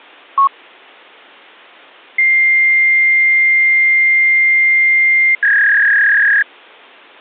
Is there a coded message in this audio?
Yes: fax machine handshake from 0.4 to 6.4 s, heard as a long tone and a warble.